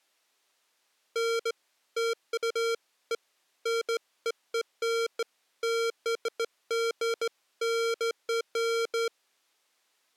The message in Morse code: none

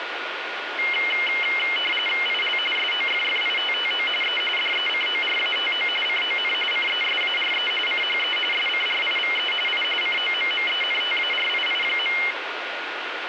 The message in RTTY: IL SOFFITTO E DECORATO CON CESARE CHE SCRIVE I COMMENTARII.

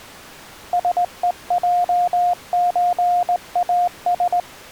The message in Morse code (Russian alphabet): СЕЙЧАС

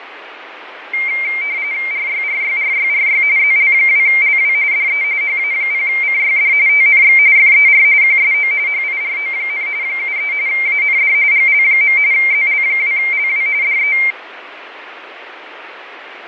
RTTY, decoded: RYRYRYRY ZL2LW DE HA0CYD TNX FER QSO HIRO, 73 AND GL. ZL2LW DE

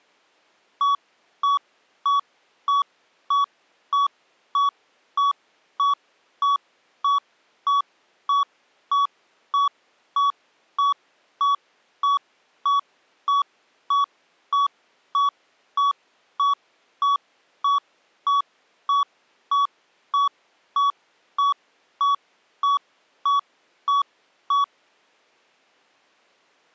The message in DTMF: none

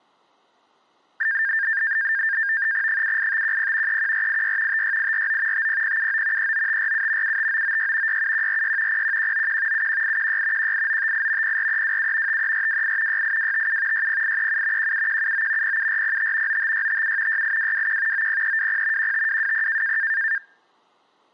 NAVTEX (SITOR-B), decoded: 78510 31486 56849 50079 39547 75996 67146 01191 71816 18958 04327 53428 68257 60837 17179 07405 95657 68221 90320 15220

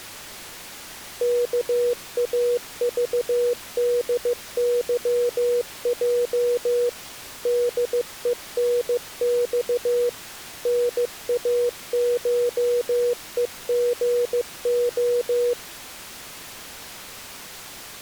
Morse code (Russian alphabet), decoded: КАЖДЫЙ ДЕНЬ НАШЕГО

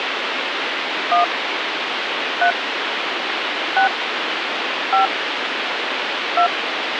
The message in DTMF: 1 3 6 5 2

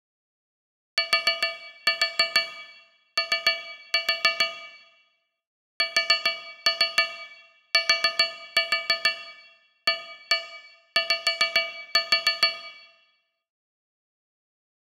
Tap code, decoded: TO STAY

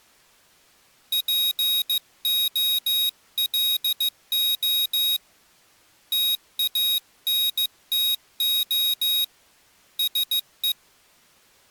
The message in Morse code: POLO TANTO SE

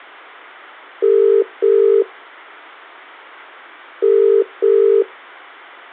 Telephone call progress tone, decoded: ringback tone

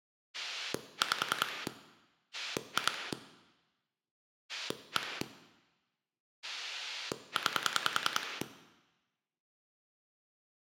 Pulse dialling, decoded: 5 2 1 9

